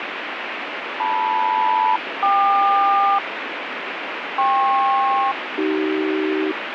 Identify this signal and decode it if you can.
Aircraft SELCAL, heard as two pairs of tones, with radio static. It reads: LM-KQ KP-AC